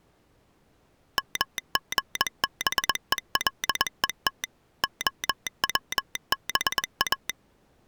Morse code (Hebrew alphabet), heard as a telegraph sounder, machine-sent, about 21 wpm. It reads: מגבולות הצבא